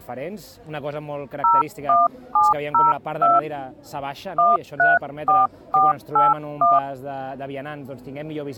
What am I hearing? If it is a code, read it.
DTMF, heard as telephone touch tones, dialled by hand, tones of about 180 ms. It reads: 01702 134481